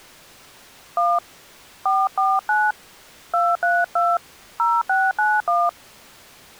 DTMF, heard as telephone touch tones, dialled by hand, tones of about 220 ms. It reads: 1 449 232 0691